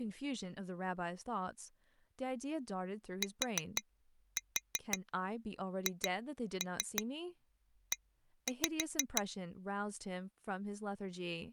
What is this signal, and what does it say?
Tap code, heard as taps on glass, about 5 knocks a second, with speech in English. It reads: THE